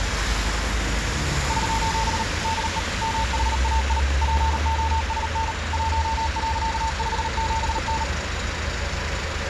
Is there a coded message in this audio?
Yes: Morse code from 1.4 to 8.1 s, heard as a keyed tone, machine-sent, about 38 wpm, 900 Hz, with radio static and street noise. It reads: <SOS> DE MHAI POSN 1.57N